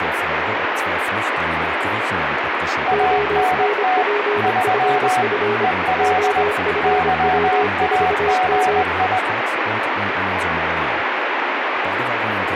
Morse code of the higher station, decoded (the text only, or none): ANT 3 EL YAGI